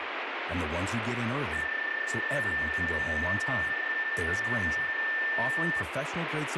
PSK31 (31.25 baud), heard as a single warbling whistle, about 1800 Hz, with radio static and speech in English.